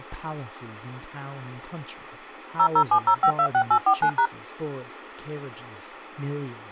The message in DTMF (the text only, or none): 0070526849#